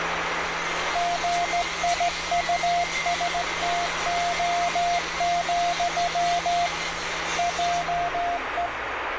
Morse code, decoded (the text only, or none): GIUSTO, JE